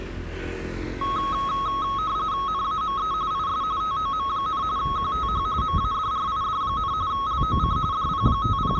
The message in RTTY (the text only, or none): NAME IS TOM, QTH MADRID, LOC …